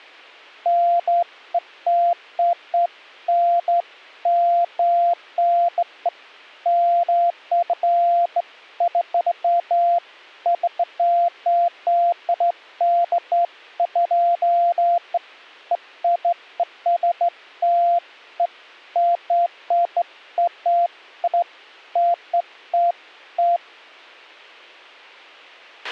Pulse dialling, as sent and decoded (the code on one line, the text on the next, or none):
none